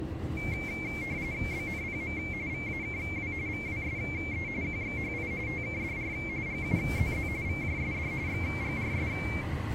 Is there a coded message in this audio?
Yes: RTTY (45.45 baud, 170 Hz shift) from 0.4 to 9.4 s, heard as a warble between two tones, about 2250 Hz centre, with the noise inside a car. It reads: BNPM VAKW VWSE QXHI TKDR GUZZ VJSD XGRS